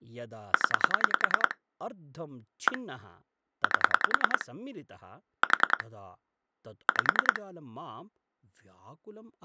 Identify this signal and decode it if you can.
Pulse dialling, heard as clicks on a phone line, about 10 pulses a second, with speech in Sanskrit. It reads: 0 1 8 4 5